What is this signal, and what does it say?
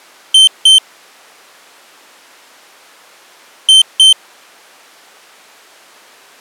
Beep code, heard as a piezo beeper, played twice, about 3100 Hz. 2 short. In AMI BIOS tables: memory parity error; in IBM BIOS tables: self-test error shown on screen; in Dell tables: no memory detected.